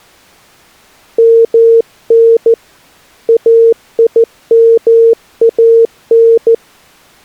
Morse code (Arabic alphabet), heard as a keyed tone, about 14 wpm, 460 Hz. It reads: من ايمان